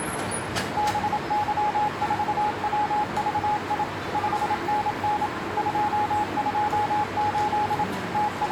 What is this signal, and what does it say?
Morse code, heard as a keyed tone, machine-sent, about 27 wpm, 840 Hz, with radio static, a narrow filter and the noise of a subway station. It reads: BY4WVI 5NN 228 …